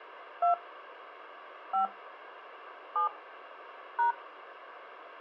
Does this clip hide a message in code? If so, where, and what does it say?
Yes: DTMF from 0.4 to 4.1 s, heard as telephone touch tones, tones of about 120 ms. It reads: 2 5 7 #